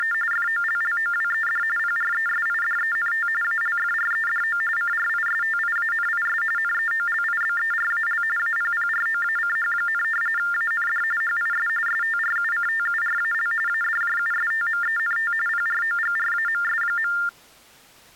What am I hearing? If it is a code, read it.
TTY/TDD text telephone tones (45.45 baud Baudot), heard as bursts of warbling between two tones, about 400 Hz shift, 1600 Hz centre. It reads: … FOLLOWED PRESIDENT ALFREDO CRISTIANIS NEOLIBERAL APPROACH, AND HIS STRUCTURAL ADJUSTMENT PROGRAMS.